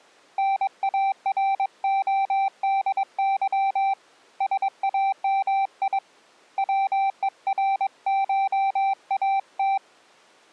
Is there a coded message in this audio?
Yes: Morse code (Russian alphabet) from 0.3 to 9.8 s, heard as a keyed tone, hand-sent with a paddle, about 22 wpm, 780 Hz. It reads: НАРОДЫ САМИ ВЕРШАТ